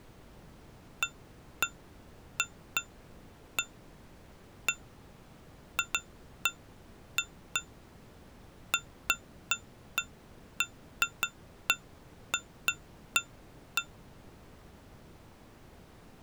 Irregular taps on glass. There is no code.